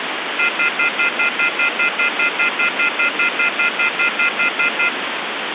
Telephone call progress tone (North American plan), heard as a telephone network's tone, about 1400, 2050, 2450, 2600 Hz, 0.1 s on and 0.1 s off, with phone line noise. Off-hook warning tone.